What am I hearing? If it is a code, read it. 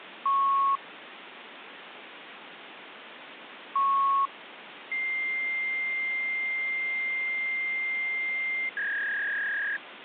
Fax machine handshake, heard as beeps, a long tone and a warble, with phone line noise.